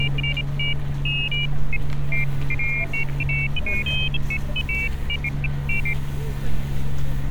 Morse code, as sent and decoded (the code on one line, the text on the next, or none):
none